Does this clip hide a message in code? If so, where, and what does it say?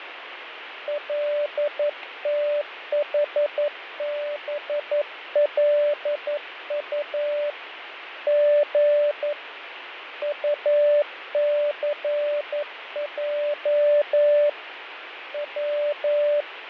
Yes: Morse code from 0.8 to 16.5 s, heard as a keyed tone, hand-sent with a paddle, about 11 wpm, 590 Hz, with radio static and fading. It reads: LTHBLU G UCJ W